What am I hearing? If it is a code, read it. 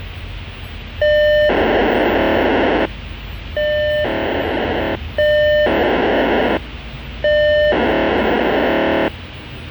POCSAG pager data (1200 baud), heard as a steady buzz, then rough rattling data, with the noise inside a bus.